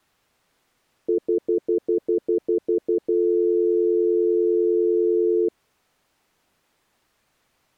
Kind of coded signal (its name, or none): telephone call progress tone